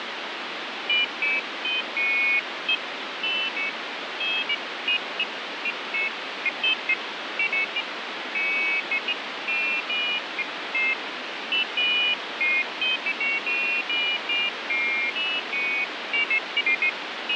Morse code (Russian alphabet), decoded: none

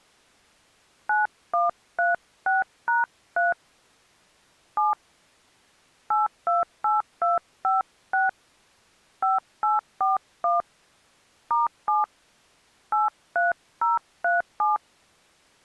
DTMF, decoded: 9136#3 7 828256 5841 *7 83037

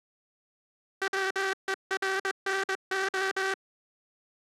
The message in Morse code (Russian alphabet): ВЕРНО

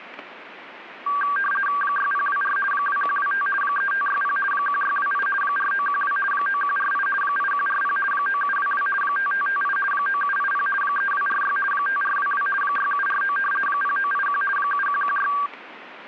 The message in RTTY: 6024 2125 3560 1628 4912 9148 8140 9722 5558 9780 3246 5422 6749 0981 7116

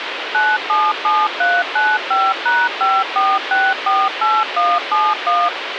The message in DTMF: 977395#54648171

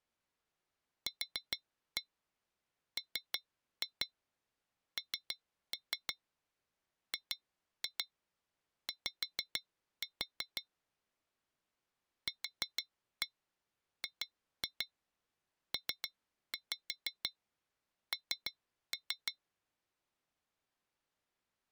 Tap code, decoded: QMNGY QGPN

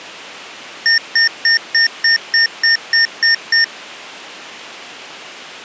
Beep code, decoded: 10 short

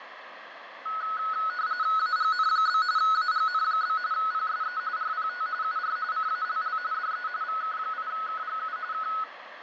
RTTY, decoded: AGN? AGN? PSE RPT UR CALL DE VK8KGU K

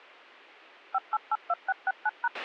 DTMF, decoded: 5882669#

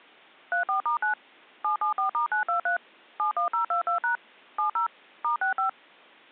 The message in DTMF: 34*9 774*923 71022# 70 *65

